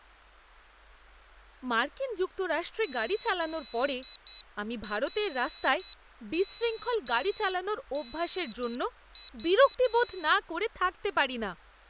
Morse code (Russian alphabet), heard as a high beeper, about 10 wpm, 3950 Hz, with speech in Bangla. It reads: ЗРМНЖ